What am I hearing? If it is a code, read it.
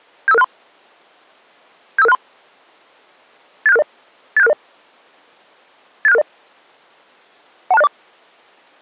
Five-tone selective call (EIA), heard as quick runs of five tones, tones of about 30 ms. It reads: 75563 75563 87660 87660 87660 12604